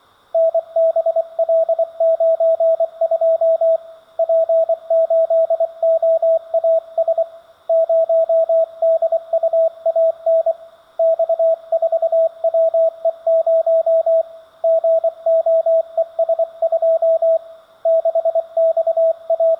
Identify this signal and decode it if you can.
Morse code, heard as a keyed tone, hand-sent with a paddle, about 24 wpm, 650 Hz. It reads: NBL92 P8OAS 0DUAN X4WE0 GOES2 …